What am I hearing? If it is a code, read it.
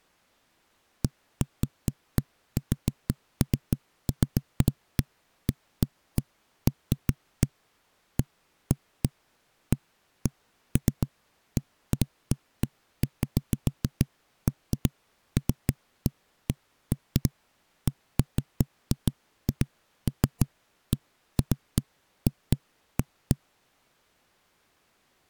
Irregular knocks on a wall. There is no code.